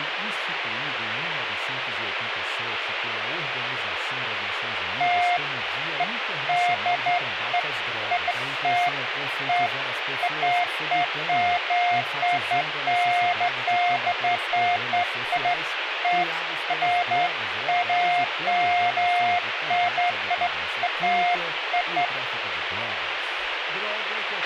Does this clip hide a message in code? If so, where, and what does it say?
No, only beeps of irregular length, with radio hiss and a squelch burst at the end.